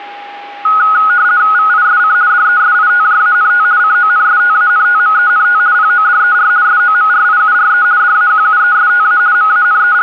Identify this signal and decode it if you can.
RTTY (50 baud, 170 Hz shift), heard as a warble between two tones, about 1360 Hz centre, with a steady whistle near 810 Hz. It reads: VISC DESITJANT CONSTANTMENT PODER SOMRIURE DAQUESTA …